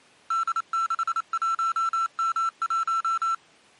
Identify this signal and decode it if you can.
Morse code, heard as electronic beeps, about 28 wpm, 1340 Hz. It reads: D61M1